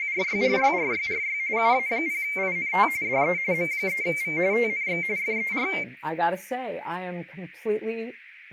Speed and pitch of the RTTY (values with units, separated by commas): 45.45 baud, 170 Hz shift, 2200 Hz centre